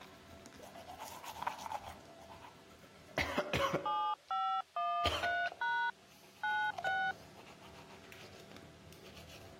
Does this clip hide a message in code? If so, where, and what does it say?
Yes: DTMF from 3.9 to 7.1 s, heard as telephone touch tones, dialled by hand, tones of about 280 ms, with the noise of a restroom. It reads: 7513# 96